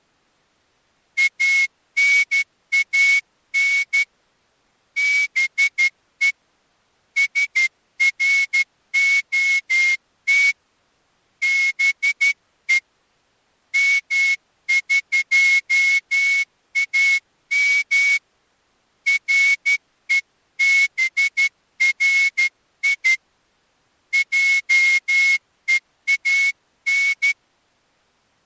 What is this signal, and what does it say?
Morse code (Persian alphabet), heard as a whistle, hand-sent with a straight key, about 12 wpm. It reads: انان به سرعت به مقام رهبری جهان